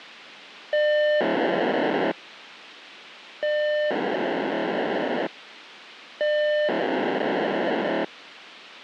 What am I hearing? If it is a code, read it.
POCSAG pager data (1200 baud), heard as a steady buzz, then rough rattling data, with radio hiss.